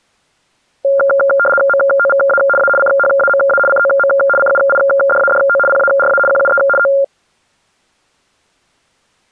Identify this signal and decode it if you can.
RTTY (75 baud, 850 Hz shift), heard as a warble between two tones, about 980 Hz centre. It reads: MOVA A CHAMA COM CUIDADO PARA QUE O